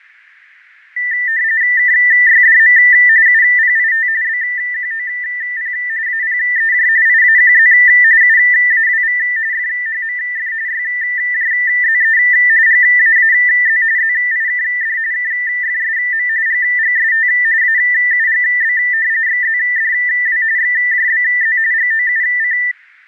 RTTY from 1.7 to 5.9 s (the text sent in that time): KYDM UPIT BQOP